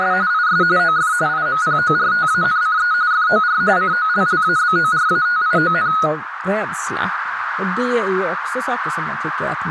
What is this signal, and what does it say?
RTTY (45.45 baud, 170 Hz shift), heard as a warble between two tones, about 1360 Hz centre, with radio static, a narrow filter and speech in Swedish. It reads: … IS OF IMPORTANCE FOR COLLABORATION